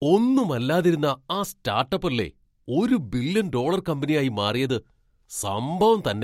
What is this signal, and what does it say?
Speech in Malayalam. There is no code.